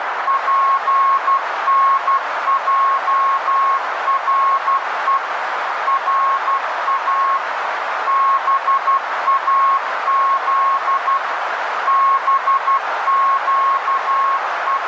Morse code (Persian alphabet), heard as a keyed tone, machine-sent, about 12 wpm, 1090 Hz, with radio static and a narrow filter. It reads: پنجره را باز …